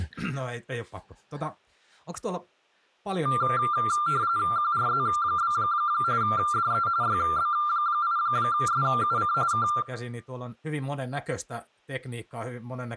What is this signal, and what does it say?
RTTY (45.45 baud, 170 Hz shift), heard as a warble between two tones, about 1280 Hz centre, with speech in Finnish. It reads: QRZ? DE YB8SUC K